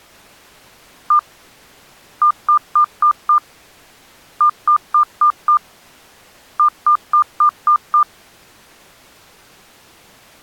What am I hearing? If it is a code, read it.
Beep code, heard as beeps, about 1200 Hz. 1-5-5-6.